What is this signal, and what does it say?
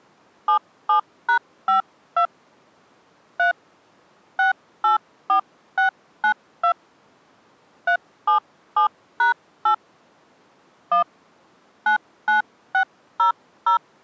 DTMF, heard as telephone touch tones, dialled by hand, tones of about 110 ms. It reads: 77#52 3 684692 377#8 1 99600